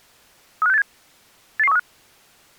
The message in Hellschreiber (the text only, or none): none